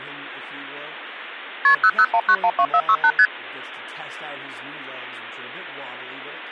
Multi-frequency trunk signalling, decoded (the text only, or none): KP 001912468 ST